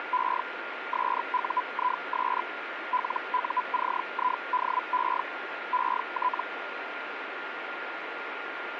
Hellschreiber (Feld-Hell, 122.5 baud), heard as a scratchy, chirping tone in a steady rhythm, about 1000 Hz, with radio static and a steady whistle near 1410 Hz. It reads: … SUIS LUCIDE ET